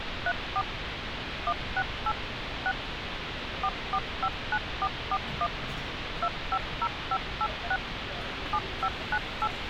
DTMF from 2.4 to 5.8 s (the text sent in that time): 6 4459441